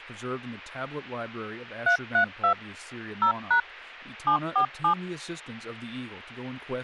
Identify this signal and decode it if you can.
DTMF, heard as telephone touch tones, dialled by machine, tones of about 100 ms, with speech in English. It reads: 332 0# 747